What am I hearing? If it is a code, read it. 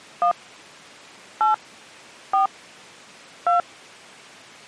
DTMF, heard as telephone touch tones, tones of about 120 ms. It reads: 1 8 4 2